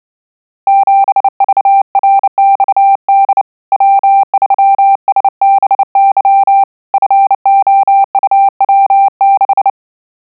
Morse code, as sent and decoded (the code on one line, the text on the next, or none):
--... ...- .-. -..- -.. / .-- ...-- ... -... -.-- / ..-. --- ..- .-- -....
7VRXD W3SBY FOUW6